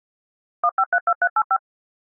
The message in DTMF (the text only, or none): 1532385